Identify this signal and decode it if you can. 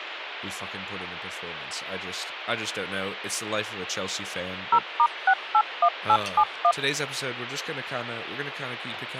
DTMF, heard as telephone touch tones, dialled by machine, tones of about 70 ms, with radio hiss and speech in English. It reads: 0*681871